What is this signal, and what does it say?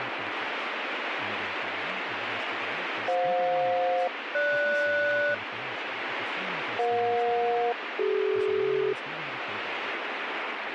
Aircraft SELCAL, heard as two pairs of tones, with radio static and speech in English. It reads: FJ-GS EJ-CD